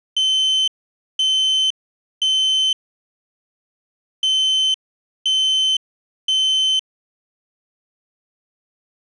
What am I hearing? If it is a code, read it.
Alarm pattern, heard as an alarm's beeps, played twice, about 3050 Hz. Temporal three. Smoke or fire, evacuate.